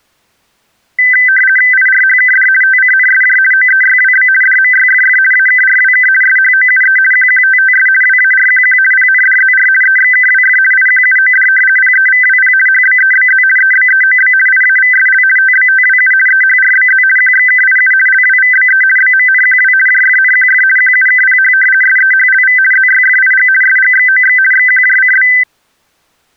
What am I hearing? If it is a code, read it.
RTTY (50 baud, 450 Hz shift), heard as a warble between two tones, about 1800 Hz centre. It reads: IRHKD TCNSJ OEYWB DMYFF AKRWK SHOUE QQTTS WARQQ PNDZR EXKWF IQUOD PEVWP HBEBZ EBEOB IAVSL TBTWU EHRBZ QXKIU LWVBE BMNQW JFNQF QUKPH SEHLV ZYFIG SGXOX XQJCB